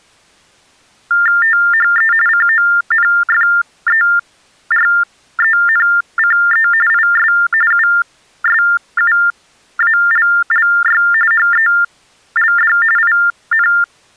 TTY/TDD text telephone tones (45.45 baud Baudot), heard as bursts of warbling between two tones, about 400 Hz shift, 1600 Hz centre. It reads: THE CONFERENCE IS USUALLY HELD IN